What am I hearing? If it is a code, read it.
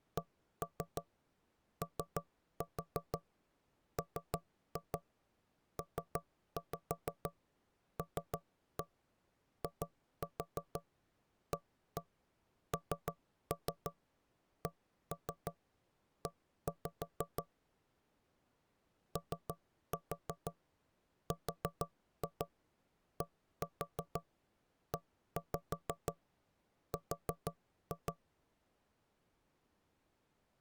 Tap code, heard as knocks on wood, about 6 knocks a second. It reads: COMPLIANCE ORDER